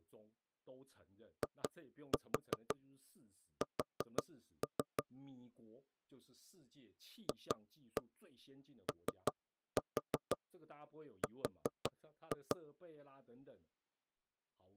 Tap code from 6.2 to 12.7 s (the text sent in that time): FOR